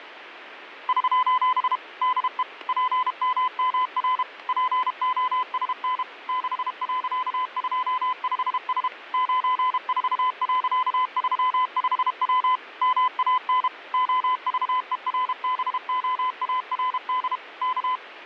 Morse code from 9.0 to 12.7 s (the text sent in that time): 94.35W